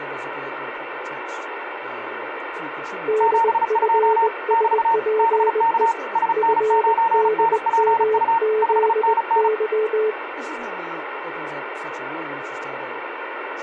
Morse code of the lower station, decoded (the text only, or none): DFSPE FDMZY